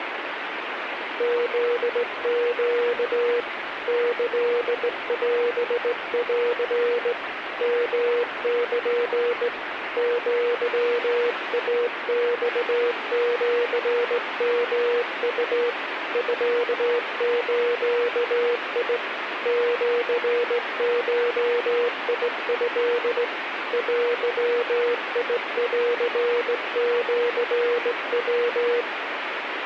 Morse code (Japanese Wabun code), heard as a keyed tone, hand-sent with a straight key, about 18 wpm, 480 Hz, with radio static. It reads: フネ キオン ヨル アイマシヨウ ミズ シゴト デンシヤ